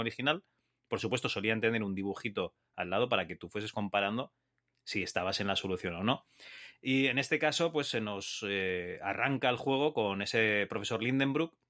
Speech in Spanish. There is no code.